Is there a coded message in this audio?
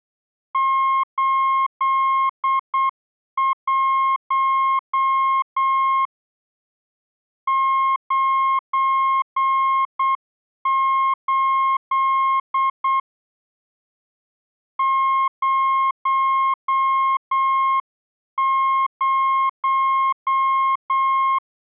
Yes: Morse code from 0.5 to 21.4 s, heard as a keyed tone, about 8 wpm, 1070 Hz. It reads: 81 98 00